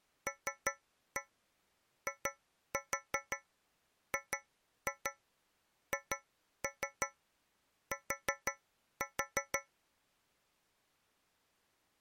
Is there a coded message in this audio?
Yes: tap code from 0.3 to 9.7 s, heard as taps on a metal pipe, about 5 knocks a second. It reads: LIGHT